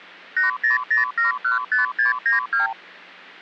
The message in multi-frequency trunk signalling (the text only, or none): 800715692